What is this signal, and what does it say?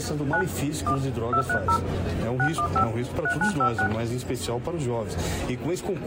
DTMF, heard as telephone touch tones, dialled by hand, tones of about 80 ms. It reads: 9 1 230 615 3956